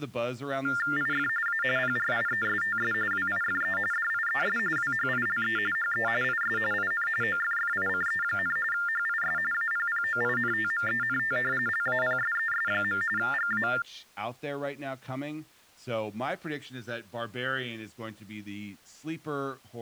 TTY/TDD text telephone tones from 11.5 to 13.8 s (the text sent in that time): LAPSES. GA